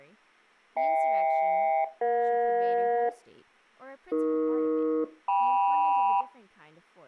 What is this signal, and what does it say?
Aircraft SELCAL, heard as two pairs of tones, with speech in English. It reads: HK-EJ AE-KM